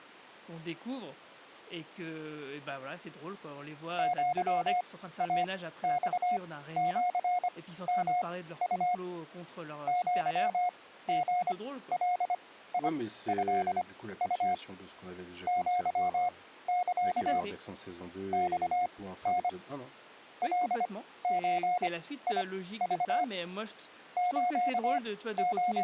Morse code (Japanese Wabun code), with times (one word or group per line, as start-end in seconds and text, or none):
4.0-8.9 アイマシヨウ
9.9-14.5 アリガトウ
15.5-17.4 アサ
18.3-19.5 マタ
20.4-23.2 カゾク
24.2-25.8 …